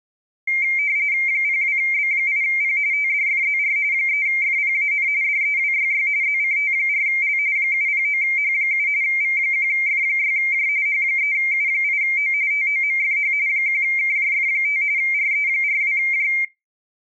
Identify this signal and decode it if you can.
RTTY (45.45 baud, 170 Hz shift), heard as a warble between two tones, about 2200 Hz centre. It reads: 02B8P TDFZR 3FPAN DEWYY ZCT4L 709H7 V1F6J H3U8O TOMFH 1KJF5 RE42J